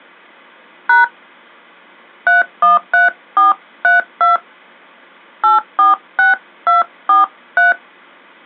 DTMF, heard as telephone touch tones, dialled by hand, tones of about 150 ms. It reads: # 313432 846243